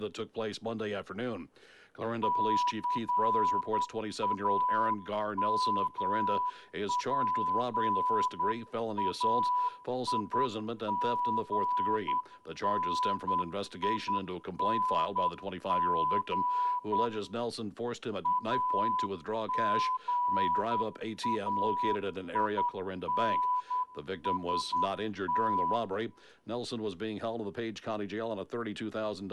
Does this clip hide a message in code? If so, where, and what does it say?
Yes: Morse code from 2.2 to 25.8 s, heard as a whistle, hand-sent with a straight key, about 10 wpm, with room echo. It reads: CAMPAIGNING AGAINST